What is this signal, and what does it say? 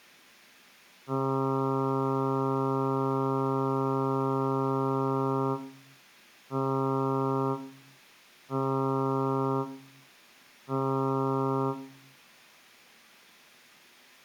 Ship horn signal, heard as a ship's horn, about 140 Hz, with room echo. 1 long, 3 short. At sea: a vessel under tow in fog.